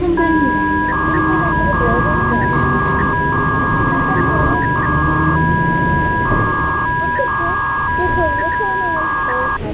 300-baud modem data (V.21 tones), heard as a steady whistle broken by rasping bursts, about 300 baud, 200 Hz shift, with phone line noise and the noise inside a bus.